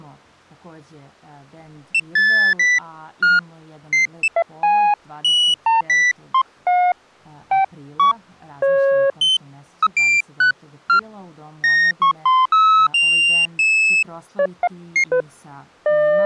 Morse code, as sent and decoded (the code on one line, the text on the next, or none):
none